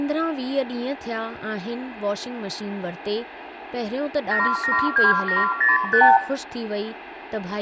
Multi-frequency trunk signalling (R2, with the far end's replies), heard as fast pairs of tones, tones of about 160 ms, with hum, room echo and speech in Sindhi. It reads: 772705